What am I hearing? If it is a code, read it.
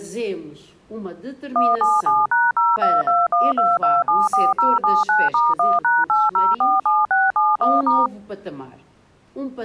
DTMF, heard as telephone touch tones, dialled by machine, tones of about 200 ms. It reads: 177#02212274079*1#8047671*